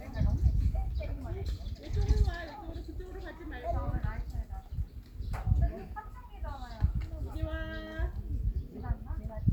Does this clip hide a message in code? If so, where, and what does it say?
No, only the noise of a park.